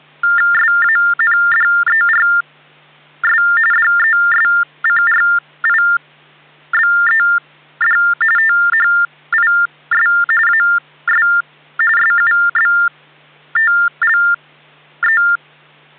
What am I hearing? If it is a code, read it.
TTY/TDD text telephone tones (45.45 baud Baudot), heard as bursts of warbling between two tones, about 400 Hz shift, 1600 Hz centre, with hum. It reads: SANDERS DESCRIBED THIS AS SUBTLE